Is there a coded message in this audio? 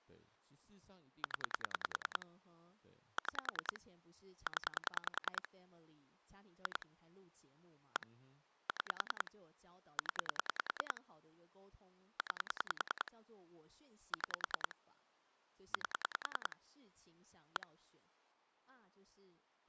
Yes: pulse dialling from 1.2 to 17.6 s, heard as clicks on a phone line, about 10 pulses a second, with speech in Chinese. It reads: 0 6 0 2 1 6 0 9 6 8 1